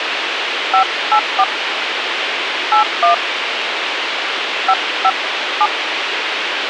DTMF, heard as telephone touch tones, dialled by hand, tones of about 100 ms, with radio hiss. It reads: 584 81 557